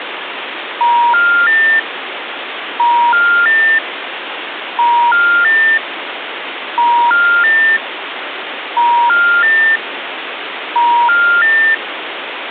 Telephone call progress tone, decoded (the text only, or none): special information tone